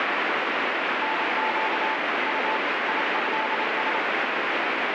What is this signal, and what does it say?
Morse code (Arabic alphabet), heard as a keyed tone, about 27 wpm, 880 Hz, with heavy radio static. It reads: نق ط يهس